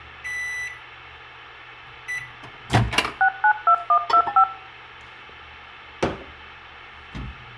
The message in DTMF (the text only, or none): 692125